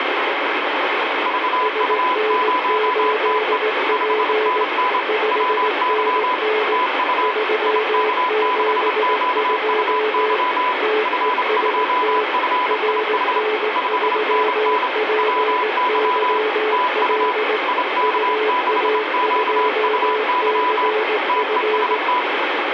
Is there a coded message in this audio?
Yes: Morse code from 1.2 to 22.3 s, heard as two keyed tones, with heavy radio static. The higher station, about 27 wpm, 1000 Hz: VU0TE 5NN WY TU IK6QUY F2FIH 5NN WY TU IK6QUY TEST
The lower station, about 18 wpm, 430 Hz: SN8P 5NN 372 TEST RN3PYL UA2CF